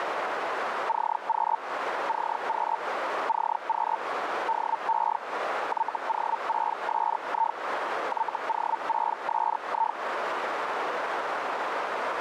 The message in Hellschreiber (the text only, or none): CQ CQ CQ DE YO6SI YO6SI